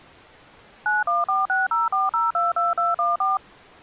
DTMF, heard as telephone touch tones, dialled by machine, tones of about 170 ms. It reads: 914604022214